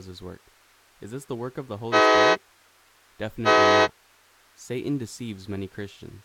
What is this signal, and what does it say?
Train horn signal, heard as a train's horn, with speech in English. 2 short. On North American railways: a signal is acknowledged.